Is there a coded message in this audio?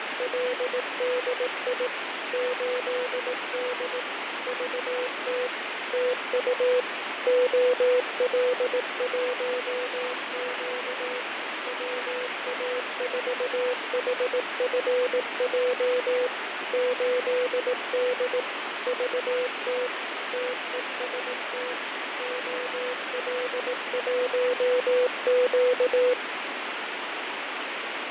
Yes: Morse code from 0.0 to 26.2 s, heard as a keyed tone, machine-sent, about 18 wpm, 500 Hz, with heavy radio static and fading. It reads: … 8D VT TU OL1Q WA4HFJ 8D VT TEST OL1Q